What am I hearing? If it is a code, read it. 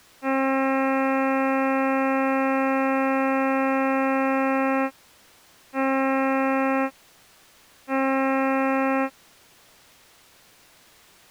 Ship horn signal, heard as a ship's horn, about 270 Hz. 1 long, 2 short. At sea: a vessel in fog that is sailing, fishing, towing or hampered.